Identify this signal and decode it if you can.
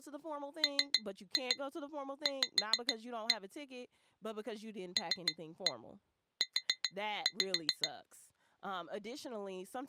Tap code, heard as taps on glass, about 6 knocks a second, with speech in English. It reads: MV LU